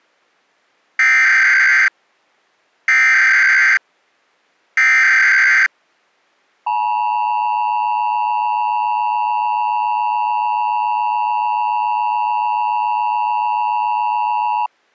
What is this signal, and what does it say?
Emergency Alert System (SAME) tones (header bursts, then the 853 and 960 Hz attention tone), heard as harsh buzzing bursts, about 520.83 baud.